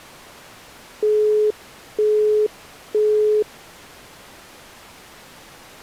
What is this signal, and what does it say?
Telephone call progress tone (single-tone plan, as in Europe, Japan and elsewhere), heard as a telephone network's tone, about 420 Hz, 0.48 s on and 0.48 s off. Busy tone.